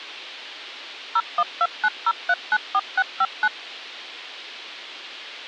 DTMF, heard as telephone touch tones, dialled by machine, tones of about 50 ms. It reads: 01290394659